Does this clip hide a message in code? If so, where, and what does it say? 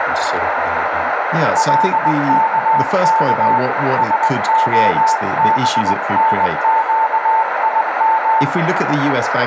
Yes: Morse code (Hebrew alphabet) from 1.5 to 8.5 s, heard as a keyed tone, hand-sent with a paddle, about 20 wpm, 890 Hz, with radio static, a narrow filter, room echo and speech in English. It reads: לכך שהבנקים